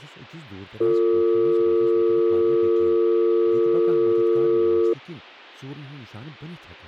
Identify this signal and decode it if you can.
Telephone call progress tone (North American or UK plan), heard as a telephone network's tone, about 350, 450 Hz, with speech in Kashmiri. Dial tone.